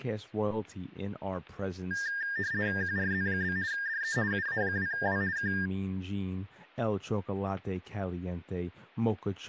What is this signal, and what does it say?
RTTY (50 baud, 170 Hz shift), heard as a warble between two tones, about 1700 Hz centre, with static crashes and speech in English. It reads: QRZ? DE UA2W K